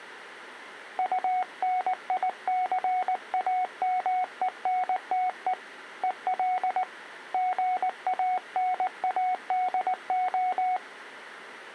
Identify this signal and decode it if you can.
Morse code, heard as a keyed tone, hand-sent with a paddle, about 19 wpm, 740 Hz. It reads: UNICAMENTE EL GANADO